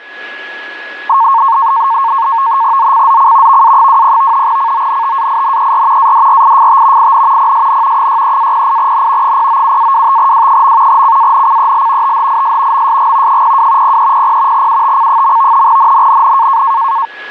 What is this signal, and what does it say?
NAVTEX (SITOR-B), 100 baud, 170 Hz shift, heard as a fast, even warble, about 1000 Hz centre, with a steady whistle near 1680 Hz. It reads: ZCZC VA20 CONTAINER ADRIFT IN PSN 63-08N 097-25W. CANCEL THIS MSG 02 0300 UTC. NNNN